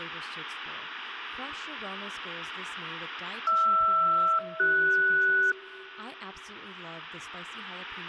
Aircraft SELCAL, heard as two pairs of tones, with speech in English. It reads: HR-CS